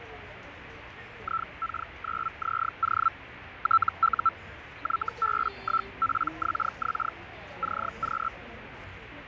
Hellschreiber (Feld-Hell, 122.5 baud), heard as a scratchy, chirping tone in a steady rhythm, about 1330 Hz, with radio static, fading and the noise of a crowd indoors. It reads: IK9ZO TU YB1PXX CQ